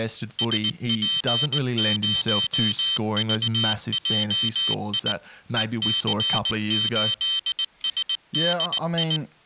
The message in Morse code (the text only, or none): SP0VJI EC8SDI